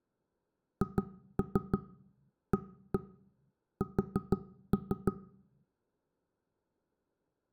Tap code, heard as knocks on wood, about 6 knocks a second. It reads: HAS